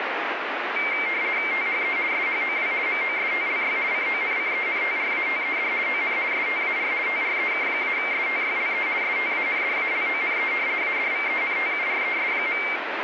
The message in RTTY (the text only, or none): THE SHOW MOSTLY CONCENTRATED ON STAR TREK-STYLE STANDALONE ADVENTURES.